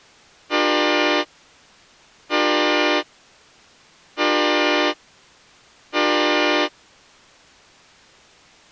Train horn signal, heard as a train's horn. 4 short. On North American railways: a request for a signal to be given or repeated.